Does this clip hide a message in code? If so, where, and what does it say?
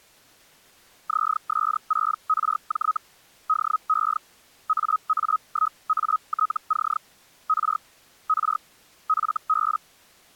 Yes: Hellschreiber (Feld-Hell, 122.5 baud) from 1.1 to 9.8 s, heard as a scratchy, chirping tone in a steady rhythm, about 1270 Hz. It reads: ZS6RJ DE AA1ATC R R FB